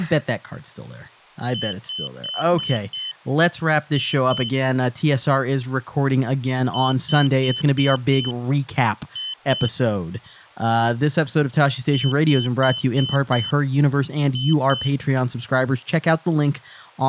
Beep code, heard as a piezo beeper, played three times, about 3050 Hz, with speech in English. 5-2.